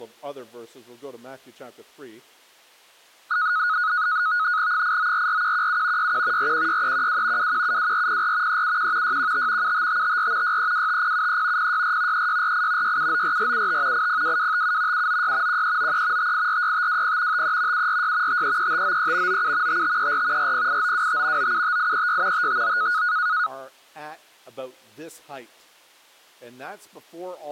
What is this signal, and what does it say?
NAVTEX (SITOR-B), 100 baud, 170 Hz shift, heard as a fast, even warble, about 1360 Hz centre. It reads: 8944117 61 416312 2172404 371 615 75554 6325073 064 3648 6794475 802257 796 1393 5846520 53 746 533593 97 5534 408925 975836 559